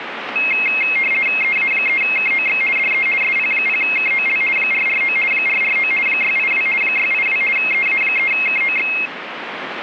RTTY (50 baud, 450 Hz shift), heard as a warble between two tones, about 2350 Hz centre, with radio static. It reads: EA3KOX DE SP0KOL 449 449 682 682 EA3KOX